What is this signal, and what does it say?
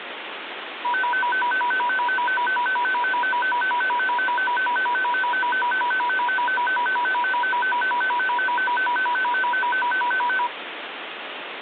A tone that alternates evenly between two pitches, with phone line noise. There is no code.